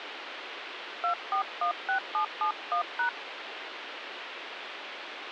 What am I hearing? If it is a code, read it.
DTMF, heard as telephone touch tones, dialled by hand, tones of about 100 ms, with phone line noise. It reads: 2416771#